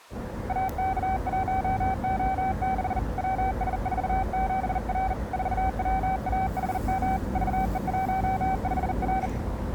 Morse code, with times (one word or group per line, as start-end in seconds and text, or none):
0.5-3.0 AK1O6
3.2-5.1 WS47R
5.3-7.2 4WAHM
7.4-9.3 VE15R